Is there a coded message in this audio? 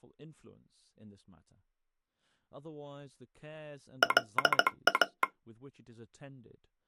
Yes: Morse code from 4.0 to 5.3 s, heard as a telegraph sounder, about 17 wpm, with speech in English. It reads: LA